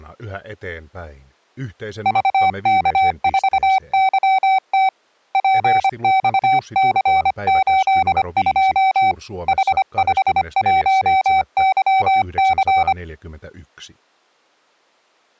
Morse code, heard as a keyed tone, hand-sent with a paddle, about 25 wpm, 760 Hz. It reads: VK4YT PXC82 H51YC